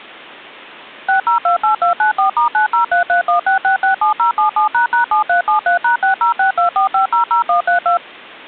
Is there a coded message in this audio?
Yes: DTMF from 1.1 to 8.0 s, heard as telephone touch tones, dialled by machine, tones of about 120 ms. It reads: 6028294*903316667077##7373#60624500132